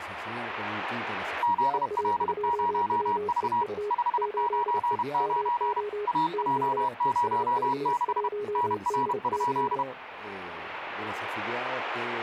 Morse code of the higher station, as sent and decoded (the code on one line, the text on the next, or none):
--.. .-.. ----- ...- / ..... ----. ----. / .- .--- ----- -.... / -. .-. ..--..
ZL0V 599 AJ06 NR?